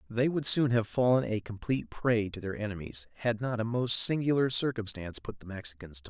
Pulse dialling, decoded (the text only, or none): none